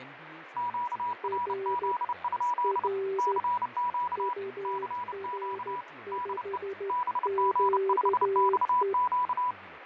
Morse code, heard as two keyed tones, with radio static, fading and speech in Malayalam. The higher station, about 30 wpm, 980 Hz: QRZ? CQ CQ DE BG5XQ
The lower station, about 13 wpm, 390 Hz: R R UR5QE